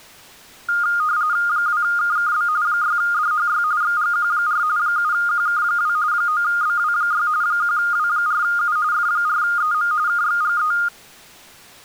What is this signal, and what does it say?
RTTY (45.45 baud, 170 Hz shift), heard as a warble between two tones, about 1320 Hz centre. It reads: 2KKB 6DHY XGQ4 7QK2 9BW6 1W4U F4EM KXGE